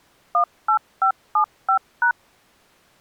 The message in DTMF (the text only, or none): 18575#